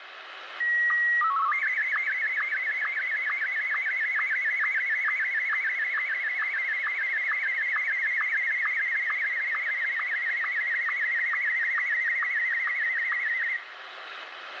SSTV (slow-scan television), Martin M1, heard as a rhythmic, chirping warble, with radio static and room echo.